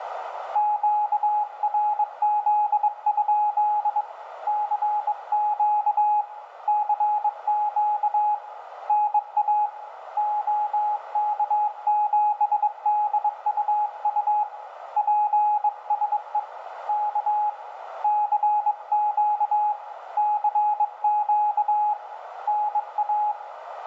Morse code, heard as a keyed tone, hand-sent with a bug key, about 22 wpm, 840 Hz, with radio static, a narrow filter and room echo. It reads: QRZ? CQ CQ NA OK7DUU PSE K CQ CQ NA